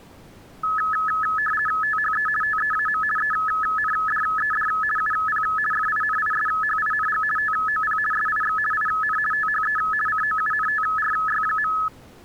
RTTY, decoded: THE TEAM ENDED UP FINISHING TOP SIX IN THE COUNTRY.

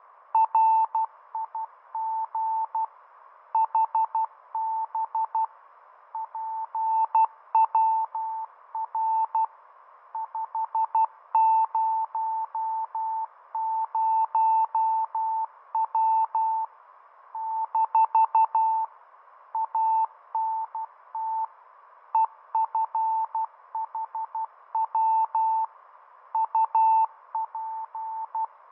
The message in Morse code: RIG HB PWR 500W - ANT EFHW UP

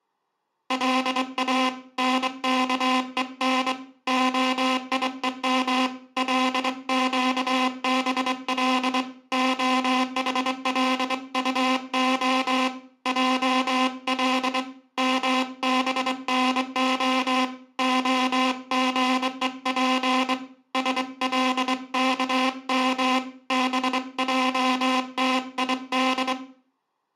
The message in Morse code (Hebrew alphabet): לא נכון היום לקבל החלטה על מבנה הגוף שלכם בעתיד

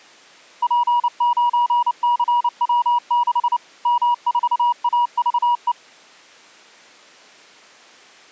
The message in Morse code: P9CW6 M4AVE

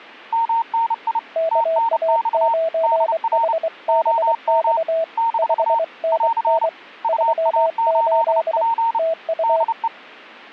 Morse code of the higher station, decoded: MNI TNX DR OM - <AR> UA8P DE

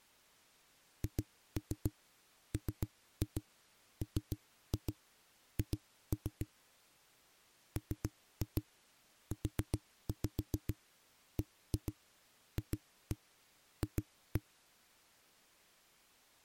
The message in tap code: HMMH MUBFF

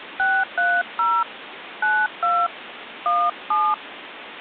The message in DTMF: 630 92 17

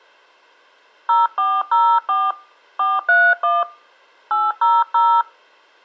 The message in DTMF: 0404 431 800

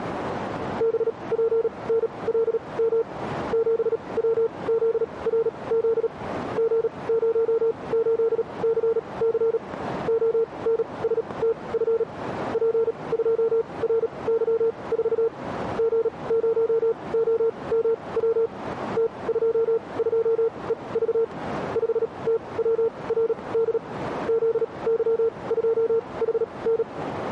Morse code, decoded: BPNLM 7WZRZ G08CC ONSTF P2RY4 G0OMW T22EV 5TWRD ZY2HN

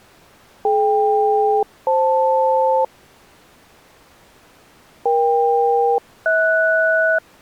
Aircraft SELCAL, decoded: DK-FL EK-HS

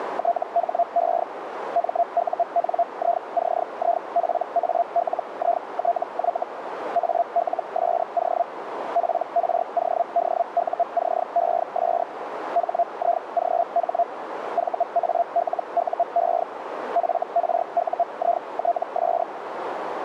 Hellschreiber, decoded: THE MUNICIPALITY ALSO PRODUCES HIGH VALUE FRUITS

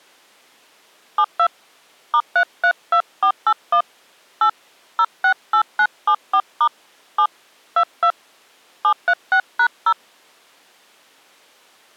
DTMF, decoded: 72 *332481 8 068974* 7 22 736#0

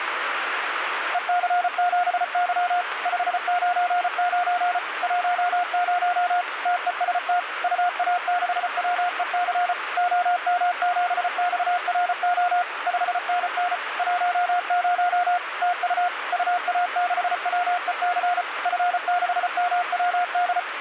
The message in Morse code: EC7Y 599 10 TEST UA6WEC OM7XRO 5NN 10 TU UA6WEC F6MWD

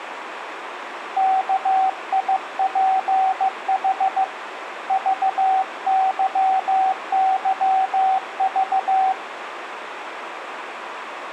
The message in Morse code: KIPH VYYV

